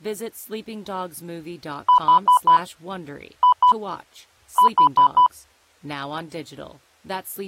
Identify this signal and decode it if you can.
Beep code, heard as beeps, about 990 Hz, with speech in English. 4-2-4. In Phoenix BIOS tables: unexpected interrupt in protected mode.